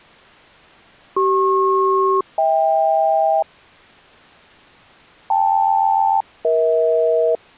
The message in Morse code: none

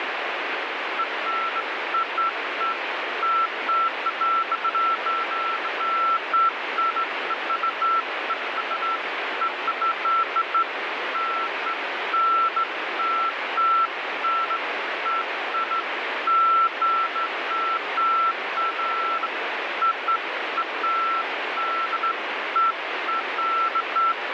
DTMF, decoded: none

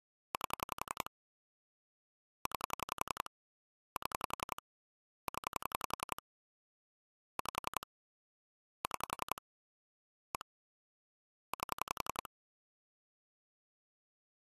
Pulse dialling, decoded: 8 9 7 0 5 6 1 8

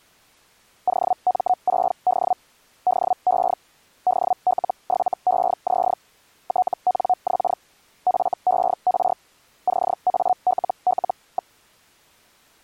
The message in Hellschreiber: OM6D DE DL7EZ TNX FER CALL.

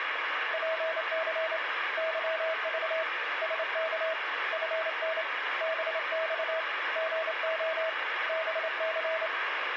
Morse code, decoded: PC YV SK FN BX GO BC

